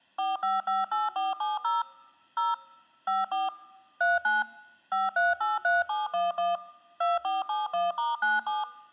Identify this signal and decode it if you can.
DTMF, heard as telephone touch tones, dialled by machine, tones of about 170 ms. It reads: 4558470 0 54 39 5383711 2471*97